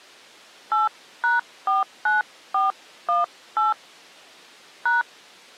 DTMF, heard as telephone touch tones, dialled by hand, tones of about 160 ms. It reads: 8#49418 #